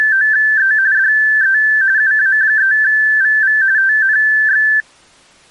RTTY (45.45 baud, 170 Hz shift), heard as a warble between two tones, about 1650 Hz centre. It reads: … DE UA3VV TNX